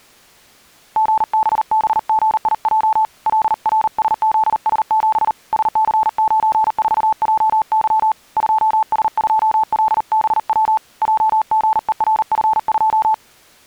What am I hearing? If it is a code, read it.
Morse code, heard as a keyed tone, hand-sent with a paddle, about 39 wpm, 870 Hz. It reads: GBBGIJ LRSZS7 SC94JY 2S2LBW JGERF2